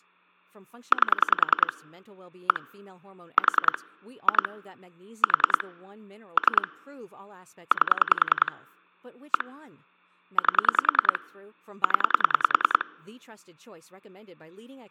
Pulse dialling, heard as clicks on a phone line, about 10 pulses a second, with speech in English. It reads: 8 1 4 2 4 3 8 1 8 0